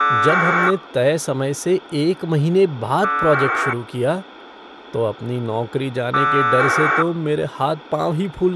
Packet radio (AX.25, as in APRS), 1200 baud, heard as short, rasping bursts, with speech in Hindi.